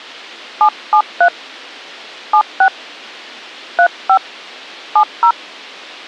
DTMF, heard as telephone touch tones, dialled by hand, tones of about 80 ms. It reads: 773 76 35 70